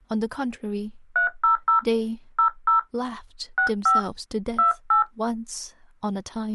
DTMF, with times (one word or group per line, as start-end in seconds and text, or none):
1.2-1.8 300
2.4-2.8 00
3.6-4.0 65
4.6-5.0 28